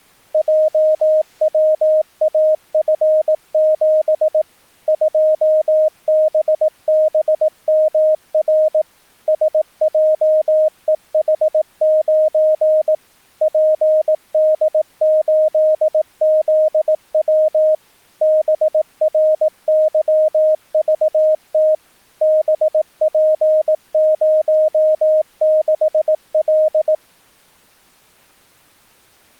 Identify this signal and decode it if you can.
Morse code, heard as a keyed tone, machine-sent, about 18 wpm, 620 Hz. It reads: JWAF7 2BBMR SJEH9 PD8ZW BRYVT BP06L